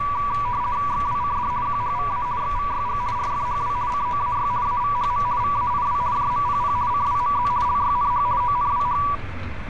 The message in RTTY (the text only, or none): XWCD QHVA XVYG RFHW COAY AVHM VAIW JMPP CWMZ LYNH ONWH